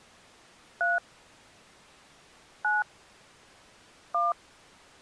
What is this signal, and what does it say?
DTMF, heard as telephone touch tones, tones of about 180 ms. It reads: 3 9 1